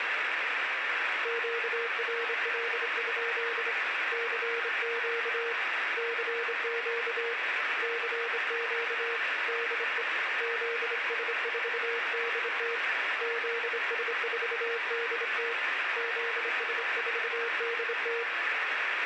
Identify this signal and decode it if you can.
Morse code, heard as a keyed tone, hand-sent with a straight key, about 26 wpm, 470 Hz, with heavy radio static and room echo. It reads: QRL? CQ CQ CQ DE ZS4DT ZS4DT ZS4DT